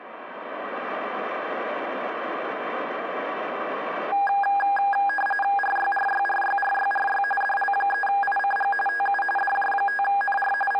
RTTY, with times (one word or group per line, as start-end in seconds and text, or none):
5.6-7.2 RYRYRYRYRY
7.4-8.7 DL3ICG
8.9-9.2 TU
9.4-10.5 DJ5NR
10.7-10.8 …